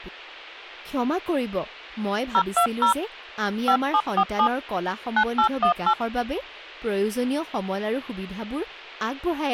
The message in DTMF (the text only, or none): 020 5747 9818